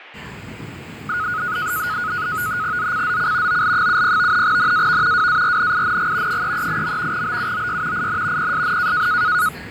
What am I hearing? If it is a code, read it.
NAVTEX (SITOR-B), 100 baud, 170 Hz shift, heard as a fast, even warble, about 1360 Hz centre, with fading and the noise inside a subway train. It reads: ZCZC OL70 NAV WARNING 338. BUOY IN PSN